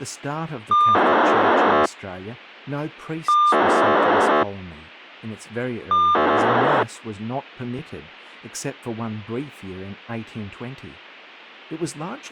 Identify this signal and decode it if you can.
POCSAG pager data (2400 baud), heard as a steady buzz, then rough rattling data, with speech in English.